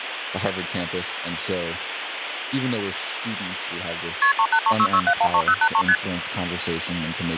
Multi-frequency trunk signalling (R1, as on North American trunks), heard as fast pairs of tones, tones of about 70 ms, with phone line noise and speech in English. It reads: KP 38366713083 ST